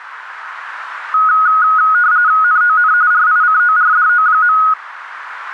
RTTY (45.45 baud, 170 Hz shift), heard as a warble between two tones, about 1360 Hz centre, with radio static. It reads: NON RICORDO.